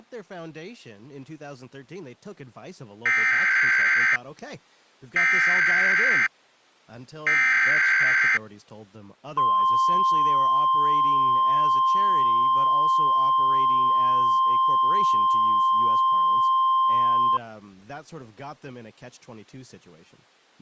Emergency Alert System (SAME) tones (header bursts, then the 1050 Hz attention tone), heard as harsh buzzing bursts, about 520.83 baud, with speech in English.